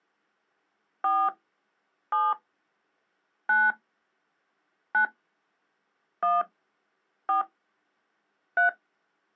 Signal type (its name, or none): DTMF